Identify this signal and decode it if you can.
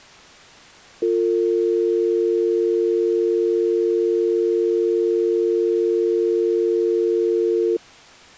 Telephone call progress tone (North American or UK plan), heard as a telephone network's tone, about 350, 450 Hz. Dial tone.